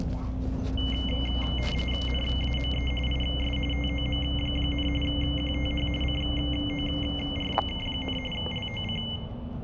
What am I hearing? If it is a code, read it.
RTTY (45.45 baud, 850 Hz shift), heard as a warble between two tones, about 2550 Hz centre, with room echo and the noise inside a bus. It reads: NAME IS TOM, QTH CORK, LOC